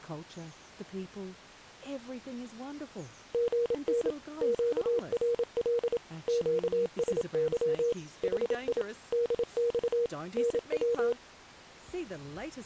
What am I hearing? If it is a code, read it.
Morse code, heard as a keyed tone, machine-sent, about 27 wpm, 470 Hz. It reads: GN QRL QSY HI DX NW